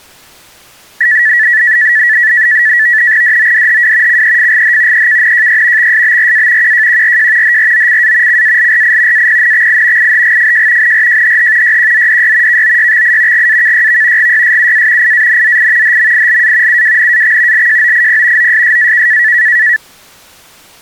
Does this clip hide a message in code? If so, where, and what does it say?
Yes: NAVTEX (SITOR-B), 100 baud, 170 Hz shift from 1.0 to 19.8 s, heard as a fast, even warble, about 1850 Hz centre. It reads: DODHW CEFGH EKNJY XSBRA QJQRJ HROCA CALRI APNXI IHGFJ NRJHH YQZDY KOYXI GAKYV GYSUA IANZI HMILA UWNAX LJOIP OSSAK